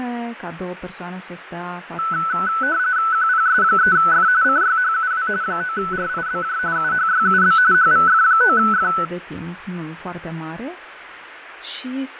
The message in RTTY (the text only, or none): QPS3F CYHUW 9RIBJ UHYUB HVF9F